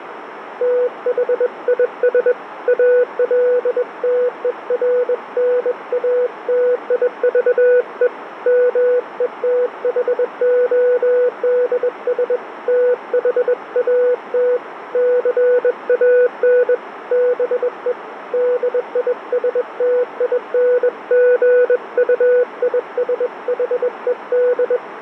Morse code, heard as a keyed tone, hand-sent with a bug key, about 21 wpm, 490 Hz, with radio static and a narrow filter. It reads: THIS ALTERNATIVE METHODS THAT CAN BE DISTINGUISHED